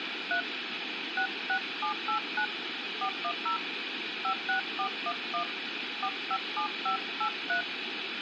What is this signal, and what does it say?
DTMF, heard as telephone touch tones, dialled by hand, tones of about 90 ms, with phone line noise. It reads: 3 66789 410 56411 457583